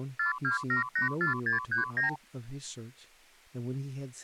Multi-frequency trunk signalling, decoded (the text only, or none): 42784639